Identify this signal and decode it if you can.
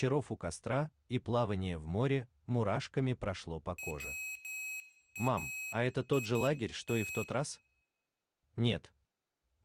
Morse code, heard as a high beeper, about 11 wpm, 2550 Hz, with room echo. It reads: WAIT